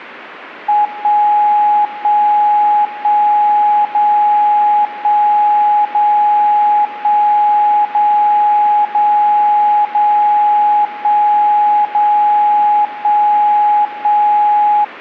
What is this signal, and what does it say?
Radio time signal (DCF77), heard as a tone whose level steps once a second, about 840 Hz. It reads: 1 1 1 0 1 0 1 0 0 0 1 0 1 1